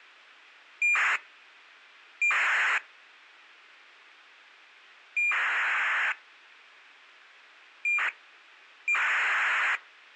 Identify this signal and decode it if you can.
ACARS aircraft data, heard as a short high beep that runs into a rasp, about 2400 baud.